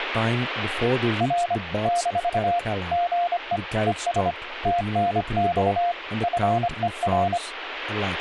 Morse code, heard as a keyed tone, hand-sent with a paddle, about 25 wpm, 700 Hz, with radio static and speech in English. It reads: R - GE ES TNX FER